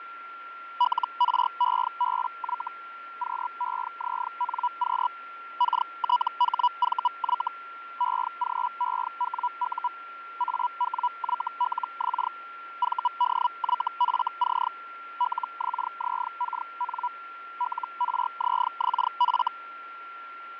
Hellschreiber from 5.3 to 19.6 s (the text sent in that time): KTHVY EGEWU AWYLX VDYFC LXZKN LRZXF